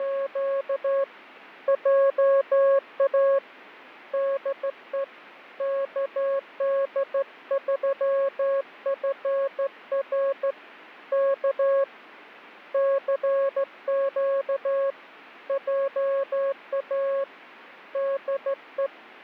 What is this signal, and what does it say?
Morse code, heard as a keyed tone, hand-sent with a straight key, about 14 wpm, 550 Hz, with fading. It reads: … JA DE KD3FR K CQ JA DE